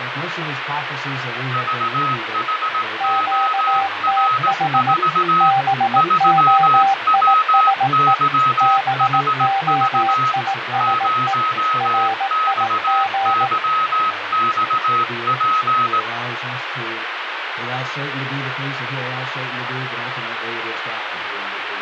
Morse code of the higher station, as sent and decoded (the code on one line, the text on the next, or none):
...- .... --- .-. ....- / ...-- .-- -.-- .... ...- / ----- -..- -.-- -..- .--.
VHOR4 3WYHV 0XYXP